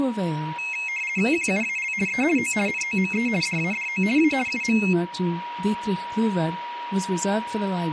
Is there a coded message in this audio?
Yes: RTTY (50 baud, 450 Hz shift) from 0.6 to 4.9 s, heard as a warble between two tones, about 2350 Hz centre, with radio static and a steady whistle near 960 Hz. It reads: QUAL E O NOME DADO A UM